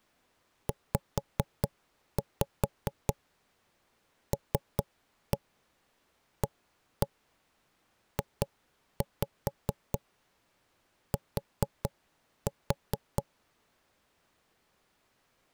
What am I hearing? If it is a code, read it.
Tap code, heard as knocks on wood, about 4 knocks a second. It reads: ZLAJT